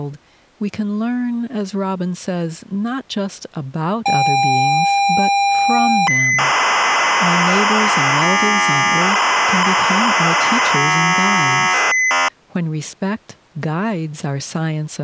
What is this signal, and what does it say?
ZX Spectrum tape loading, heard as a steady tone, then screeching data, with speech in English.